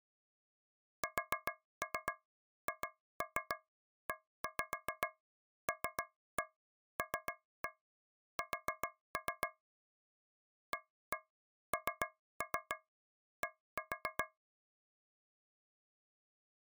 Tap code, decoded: SHELLS AND

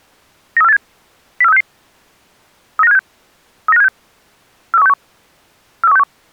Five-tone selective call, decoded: 93487 04366 39576 39576 43161 43161

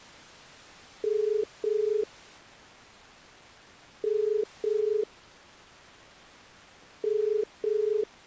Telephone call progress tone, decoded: ringback tone

